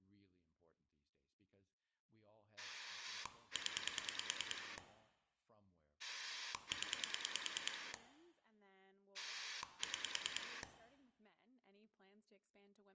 Pulse dialling, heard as a rotary dial, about 9 pulses a second, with speech in English. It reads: 0 0 6